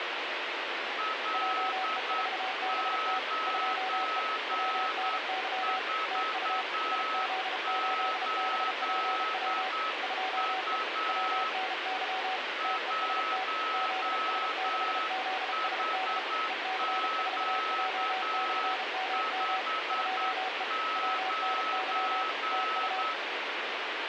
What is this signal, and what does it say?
Morse code, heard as two keyed tones, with heavy radio static. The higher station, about 9 wpm, 1290 Hz: L948U 1HQ59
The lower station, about 33 wpm, 750 Hz: JE4BT 2E WNY TU IZ8BPW 2E WNY TEST ZS6ZSD EC4J/MM 2E WNY TU